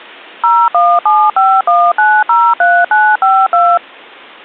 DTMF, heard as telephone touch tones, dialled by machine, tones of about 240 ms. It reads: 01751903952